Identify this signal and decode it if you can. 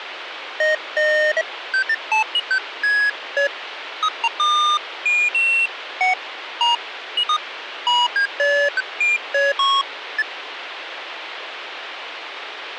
Electronic bleeps of random pitch and length, with phone line noise. There is no code.